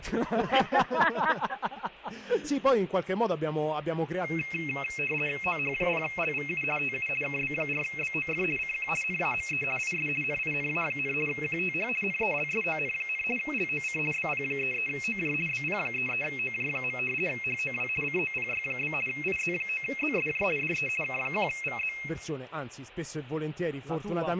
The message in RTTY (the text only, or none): OH0LVU TU KB4BOF CQ NAME IS NINA, QTH NELSON, LOC BP33OJ BP33OJ. HOW COPY? IZ9ZSJ DE K1VZ